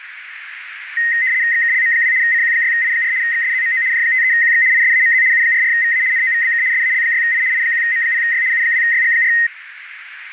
RTTY (75 baud, 170 Hz shift), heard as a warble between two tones, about 1950 Hz centre, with radio static and a narrow filter. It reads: XKLM2 CQ6I4 XSZMO J53QX ISAMZ U44VA NOVBK SAL6I I1M0Y U2YG4